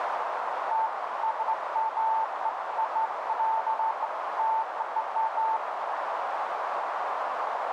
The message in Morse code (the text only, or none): none